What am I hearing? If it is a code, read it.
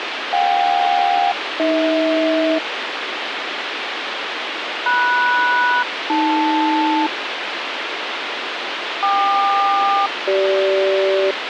Aircraft SELCAL, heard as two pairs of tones, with radio hiss and a squelch burst at the end. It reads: JK-AH MS-AL KQ-CG